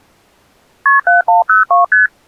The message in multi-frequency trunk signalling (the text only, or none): KP 7102 ST